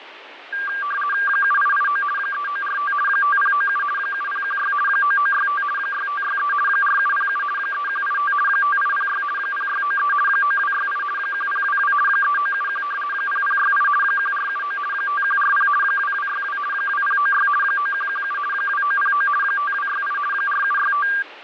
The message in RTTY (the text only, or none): 7889 3945 5097 7016 9965 6563 4707 3185 5806 0693 9268 1022 3971 0068 1479 5140 2262 2096 9117 2909 5268 4765